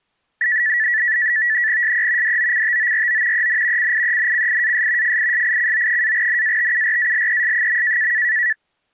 NAVTEX (SITOR-B), 100 baud, 170 Hz shift, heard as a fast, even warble, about 1850 Hz centre. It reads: SE DOCTORO EN CIENCIAS FISICO-NATURALES.